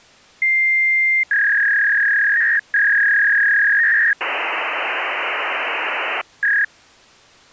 Fax machine handshake, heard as a long tone, a warble and hiss.